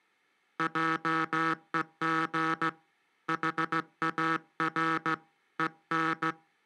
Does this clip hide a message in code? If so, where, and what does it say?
Yes: Morse code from 0.5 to 6.4 s, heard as a buzzer, hand-sent with a straight key, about 16 wpm. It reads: JEG HAR EN